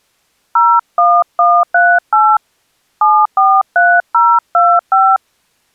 DTMF, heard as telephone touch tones, dialled by hand, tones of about 240 ms. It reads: 01138 743025